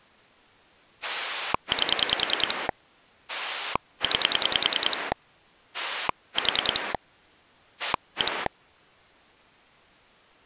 Pulse dialling, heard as a rotary dial, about 10 pulses a second. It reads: 8 9 4 1